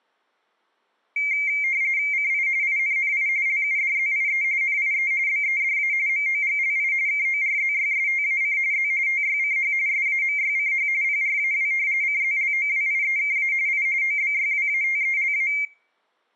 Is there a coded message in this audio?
Yes: RTTY (45.45 baud, 170 Hz shift) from 1.2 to 15.7 s, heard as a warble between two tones, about 2200 Hz centre, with room echo. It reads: CI INNI LUDZIE NIE BEDA MOGLI KORZYSTAC Z TYCH SAMYCH PRAW CZLOWIEKA I OBYWATELA